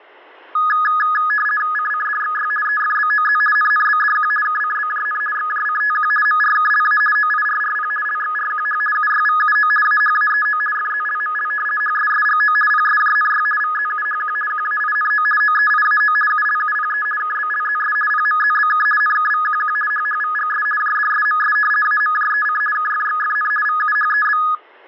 RTTY (50 baud, 450 Hz shift), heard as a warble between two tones, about 1470 Hz centre. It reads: CCDXY EFBOZ NNBDQ KCBJN XJCTQ MRKLA OIRRP LXRQH UYVUO AHAEO FZLML HSSGO PSJNY VZUHQ QAINO OEIAO ULUPE KBLZS PMZBK NKVQQ HHVGS JDSMS AMJEC KFXFN VUHEB